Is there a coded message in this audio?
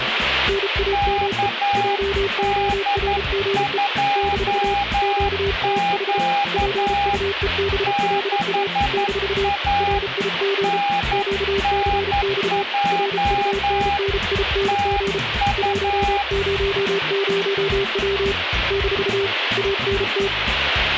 Yes: Morse code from 0.4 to 20.3 s, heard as two keyed tones, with radio static. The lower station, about 33 wpm, 400 Hz: NAME JORGE - QTH PUEBLA - RIG QCX RUNNING 100W - ANT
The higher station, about 11 wpm, 810 Hz: KD2Q 6A NNJ TU